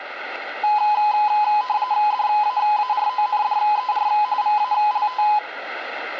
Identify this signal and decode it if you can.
RTTY (45.45 baud, 170 Hz shift), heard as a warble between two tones, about 930 Hz centre, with radio static. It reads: DAARONDER VALT